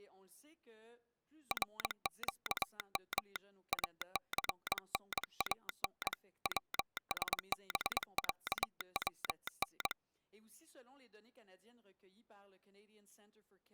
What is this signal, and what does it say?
Morse code (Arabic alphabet), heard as a telegraph sounder, hand-sent with a paddle, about 22 wpm. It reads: رقم اثنان وسبعون